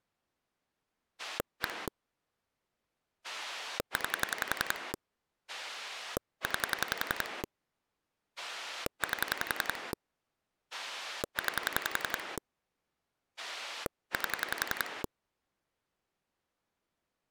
Pulse dialling, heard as a rotary dial, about 11 pulses a second. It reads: 1 9 9 8 9 8